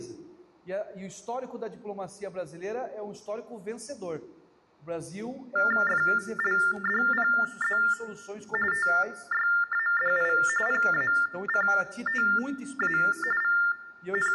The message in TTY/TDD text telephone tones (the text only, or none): FLDPZ TYADI PACTA …